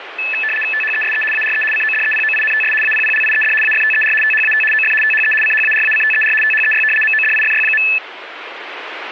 RTTY (75 baud, 850 Hz shift), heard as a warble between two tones, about 2150 Hz centre, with radio static. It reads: THESE ARE CODEPOINTS APPLIED AFTER THAT OF THE CHARACTER THEY MODIFY.